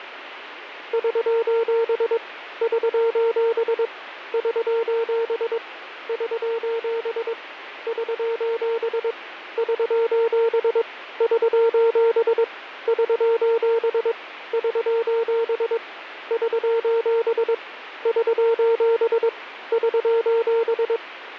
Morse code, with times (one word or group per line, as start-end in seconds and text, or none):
0.9-2.2 <SOS>
2.6-3.9 <SOS>
4.3-5.6 <SOS>
6.1-7.3 <SOS>
7.9-9.1 <SOS>
9.6-10.8 <SOS>
11.2-12.4 <SOS>
12.9-14.1 <SOS>
14.5-15.8 <SOS>
16.3-17.5 <SOS>
18.1-19.3 <SOS>
19.7-21.0 <SOS>